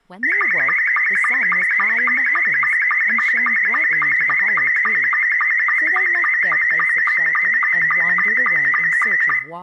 SSTV (slow-scan television), Scottie S2, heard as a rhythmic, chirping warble, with room echo and speech in English.